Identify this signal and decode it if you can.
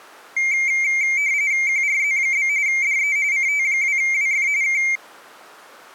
RTTY (45.45 baud, 170 Hz shift), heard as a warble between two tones, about 2200 Hz centre. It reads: QRZ? DE CT2WF K